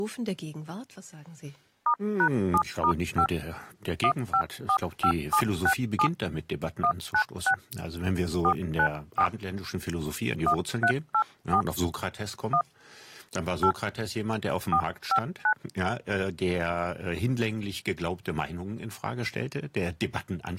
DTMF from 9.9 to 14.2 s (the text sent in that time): 1384 1 8